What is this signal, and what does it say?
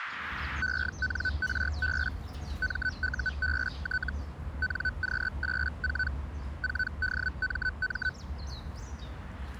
Hellschreiber (Feld-Hell, 122.5 baud), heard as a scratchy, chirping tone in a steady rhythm, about 1500 Hz, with the noise of a park. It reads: ENRB MUBT NQ84 4DMM